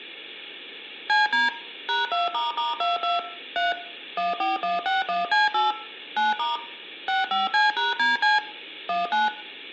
DTMF, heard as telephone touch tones, dialled by machine, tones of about 160 ms, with room echo. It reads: CD #2**22 3 14161C8 9* 65C#DC 19